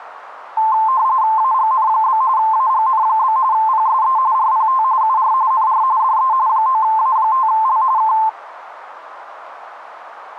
RTTY (45.45 baud, 170 Hz shift), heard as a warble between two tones, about 960 Hz centre, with radio static. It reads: AGN? AGN? PSE RPT UR NR DE 9A5L K